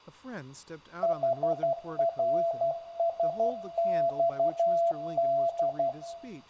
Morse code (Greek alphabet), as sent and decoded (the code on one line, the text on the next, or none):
.... .-. ... -..- -..
ΗΡΣΞΔ